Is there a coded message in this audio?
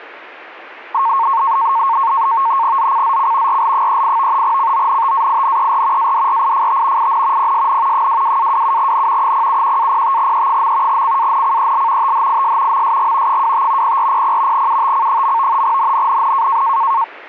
Yes: NAVTEX (SITOR-B), 100 baud, 170 Hz shift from 0.9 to 17.0 s, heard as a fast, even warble, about 1000 Hz centre. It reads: ZCZC RL38 CONTAINER ADRIFT IN PSN 22-27N 071-05E. CANCEL THIS MSG 25 0400 UTC. NNNN